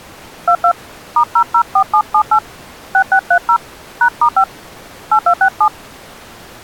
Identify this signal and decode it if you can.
DTMF, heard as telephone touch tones, dialled by hand, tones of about 80 ms. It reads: 22 *004778 6630 #*5 8267